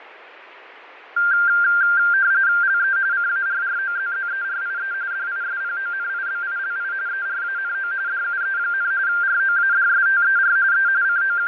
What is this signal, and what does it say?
RTTY (45.45 baud, 170 Hz shift), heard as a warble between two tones, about 1490 Hz centre, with radio static and fading. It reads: LE CARROZZERIE DISPONIBILI ERANO DUE, ROADSTER E …